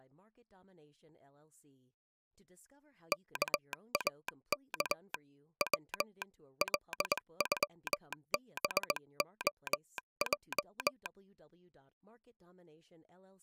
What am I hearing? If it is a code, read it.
Morse code (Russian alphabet), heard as a telegraph sounder, hand-sent with a straight key, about 20 wpm, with speech in English. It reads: КАК В ЛЮБОЙ